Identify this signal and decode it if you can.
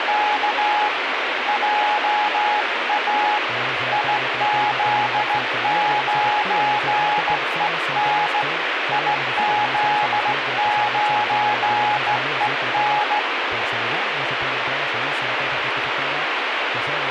Morse code, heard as a keyed tone, hand-sent with a straight key, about 16 wpm, 840 Hz, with radio static. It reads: … JA IZ9EN IZ9EN